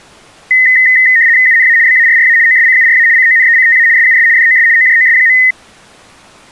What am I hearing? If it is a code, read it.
RTTY (75 baud, 170 Hz shift), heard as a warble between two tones, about 1950 Hz centre. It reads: UNA BARRA OSCURA CONECTA SUS DOS OJOS.